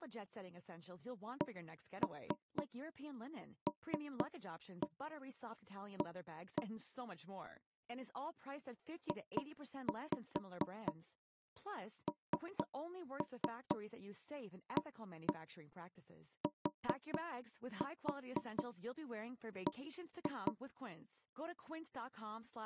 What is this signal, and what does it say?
Tap code, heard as knocks on wood, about 4 knocks a second, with speech in English. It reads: CLA JNATB